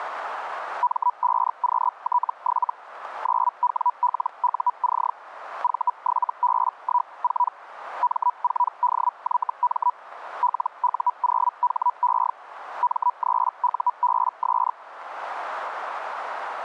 Hellschreiber (Feld-Hell, 122.5 baud), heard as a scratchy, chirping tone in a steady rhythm, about 980 Hz. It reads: M5QT7 9WLUC V7B14 M4DYM LU0HE M3UBS